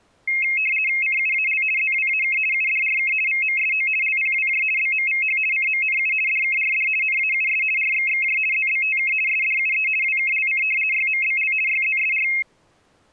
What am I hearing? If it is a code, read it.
RTTY (50 baud, 450 Hz shift), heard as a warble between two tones, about 2350 Hz centre. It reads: CUAL ZWAK UDRK VMSO LPWJ BMVH CMNU DKRD NAUS RXXJ ZBTK SDUE WKLC YMBL YZSR